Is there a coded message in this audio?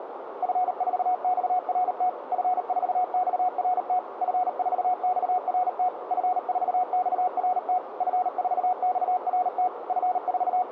Yes: Morse code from 0.4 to 10.7 s, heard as a keyed tone, machine-sent, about 38 wpm, 730 Hz, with radio static, a narrow filter and room echo. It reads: F4XRT F4XRT F4XRT F4XRT F4XRT …